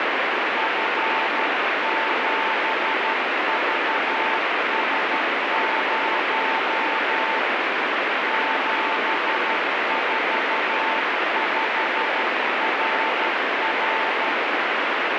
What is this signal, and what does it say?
Morse code, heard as a keyed tone, hand-sent with a paddle, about 12 wpm, 890 Hz, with heavy radio static. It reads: F7VS0 745RR